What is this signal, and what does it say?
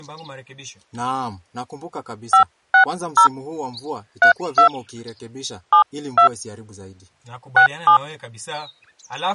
DTMF, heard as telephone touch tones, dialled by hand, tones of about 100 ms. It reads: 560 32 72 67